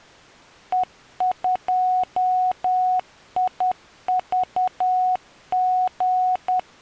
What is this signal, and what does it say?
Morse code, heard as a keyed tone, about 10 wpm, 740 Hz. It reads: E2IVG